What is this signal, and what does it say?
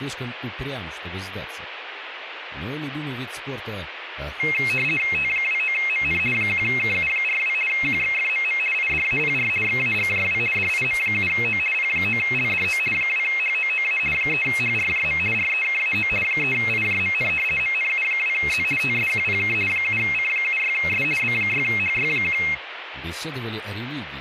RTTY (50 baud, 450 Hz shift), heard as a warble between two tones, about 2350 Hz centre, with radio static. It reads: T29MN 1KU42 QXFMM IDAPR XAGJW DIM7O P9LDO 2HOOA 3HRJM REKAO 3IJMN MNU2Z TSQPK 7C76S B6HY1